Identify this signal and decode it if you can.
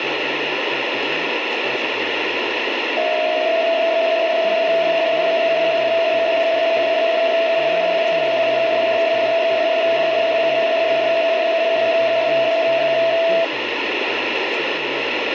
PSK63 (62.5 baud), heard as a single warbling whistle, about 660 Hz, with radio static.